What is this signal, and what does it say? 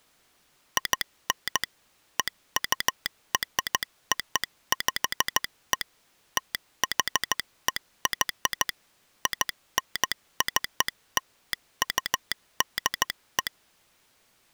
Morse code (American railroad code), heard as a telegraph sounder, machine-sent. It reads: IN EUROPE THEY INCLUDE